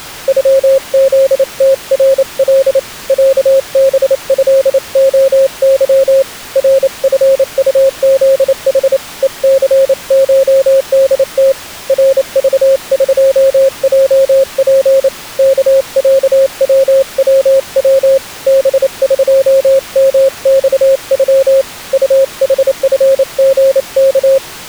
Morse code (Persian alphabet), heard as a keyed tone, hand-sent with a paddle, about 28 wpm, 540 Hz. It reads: غزترل صبضعظ رفطزح هثشدت رذقجپ کصووو بقمخغ طحفژک